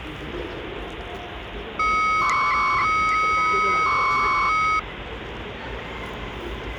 300-baud modem data (Bell 103 tones), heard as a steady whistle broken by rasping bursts, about 300 baud, 200 Hz shift, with phone line noise and the noise of a residential street.